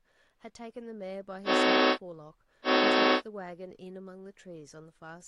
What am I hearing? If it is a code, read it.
Train horn signal, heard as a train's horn, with speech in English. 2 short. On North American railways: a signal is acknowledged.